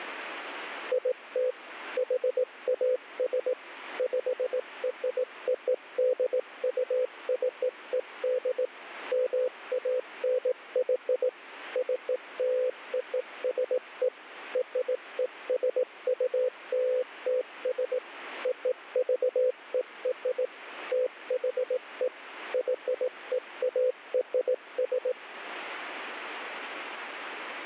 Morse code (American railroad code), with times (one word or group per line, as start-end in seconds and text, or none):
0.9-1.5 IT
2.0-3.5 HAS
4.0-8.7 PRODUCED
9.1-11.3 MANY
11.8-14.1 CLOSE
14.6-18.0 RESULTS
18.5-20.5 OVER
20.9-22.1 THE
22.5-25.1 YEARS